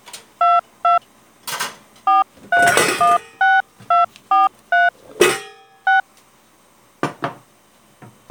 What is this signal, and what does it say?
DTMF, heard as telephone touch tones, dialled by hand, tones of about 170 ms, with kitchen noise. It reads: 22 4316243 6